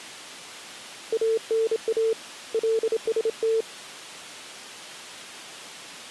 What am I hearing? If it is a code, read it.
Morse code (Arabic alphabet), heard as a keyed tone, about 27 wpm, 450 Hz. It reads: انا لست